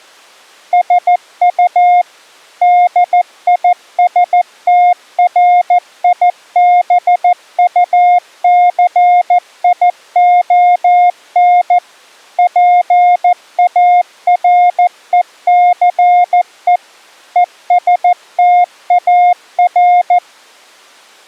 Morse code, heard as a keyed tone, machine-sent, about 14 wpm, 710 Hz. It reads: SU DISTRIBUCION PARECE ESTAR